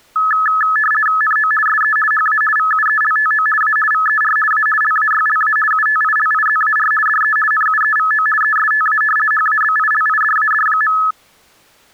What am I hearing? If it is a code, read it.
RTTY (50 baud, 450 Hz shift), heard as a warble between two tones, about 1500 Hz centre. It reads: NO SE HA VUELTO A VER A LAYLA UTILIZAR DE NUEVO ESTA HABILIDAD.